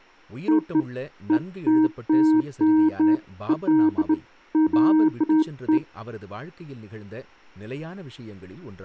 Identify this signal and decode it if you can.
Beeps of irregular length, with speech in Tamil. There is no code.